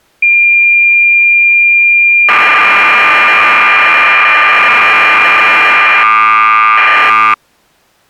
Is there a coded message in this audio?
Yes: cassette data (Kansas City type), 1200 baud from 0.2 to 7.3 s, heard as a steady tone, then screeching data.